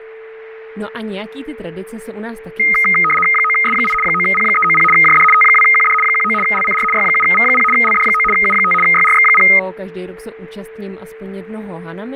RTTY (75 baud, 850 Hz shift), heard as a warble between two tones, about 1700 Hz centre, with a steady whistle near 440 Hz and speech in Czech. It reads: 9S8 9P390 JD T2QD 19 LCR Y7V0 LD9 U5 YRX0